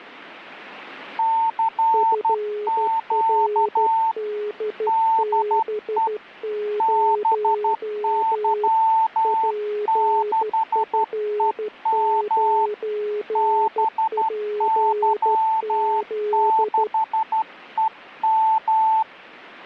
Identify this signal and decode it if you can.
Morse code, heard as two keyed tones. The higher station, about 12 wpm, 890 Hz: CQ DE BY6EM BY6EM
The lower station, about 13 wpm, 420 Hz: FRDB0 PF9PZ